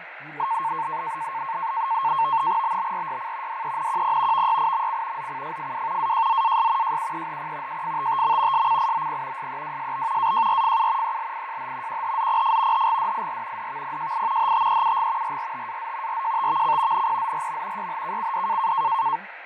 NAVTEX (SITOR-B), 100 baud, 170 Hz shift, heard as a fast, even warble, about 990 Hz centre, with radio static, fading and speech in German. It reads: BBRYC DENQP VYIMC ZCFFW AJZAS JUEHP JFTTM SCIOP SEWSB AJRFU ELIJH QHZPF HGDIR DVPJI HTEUG RRTAZ RJTVC NPZRM YHKCD